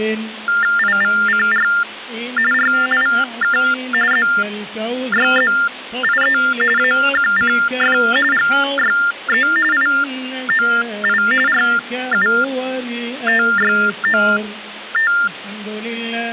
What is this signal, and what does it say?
TTY/TDD text telephone tones (45.45 baud Baudot), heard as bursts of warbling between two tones, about 400 Hz shift, 1600 Hz centre. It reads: IVCR RIK ZYZIE AQCF GYE IOI RUTYOT